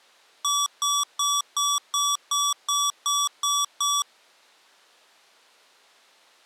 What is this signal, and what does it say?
Beep code, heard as beeps from a small speaker, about 1140 Hz. 10 short. In AMI BIOS tables: CMOS shutdown register error.